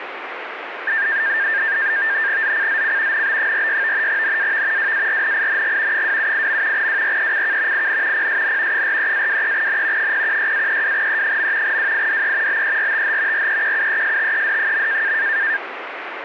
NAVTEX (SITOR-B), 100 baud, 170 Hz shift, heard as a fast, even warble, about 1700 Hz centre, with radio static. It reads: ZCZC NB46 NAV WARNING 278. WRECK IN PSN 43-23N 016-32E. WIDE BERTH REQUESTED.